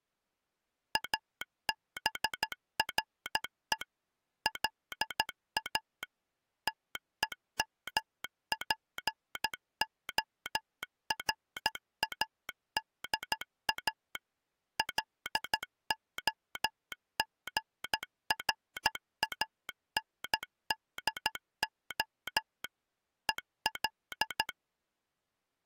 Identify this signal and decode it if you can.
Morse code, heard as a telegraph sounder, machine-sent, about 13 wpm. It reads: ABRE LA TEMPORADA LOGRANDO EL